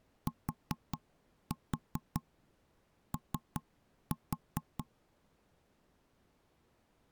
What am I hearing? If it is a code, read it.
Tap code, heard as knocks on wood, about 5 knocks a second. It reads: TO